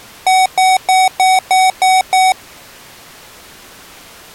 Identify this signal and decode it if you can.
Beep code, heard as beeps from a small speaker, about 750 Hz. 7 short. In AMI BIOS tables: virtual mode exception error; in Dell tables: processor failure.